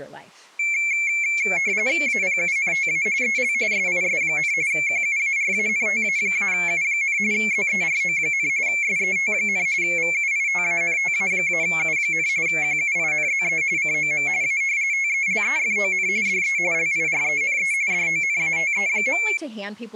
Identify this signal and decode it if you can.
RTTY (45.45 baud, 170 Hz shift), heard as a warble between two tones, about 2250 Hz centre, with speech in English. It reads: APUNTA EL SIS, QUARANTA-U, ZERO, SET, VUITANTA-U, QUINZE COM A TELEFON DE LIRENE DONATE.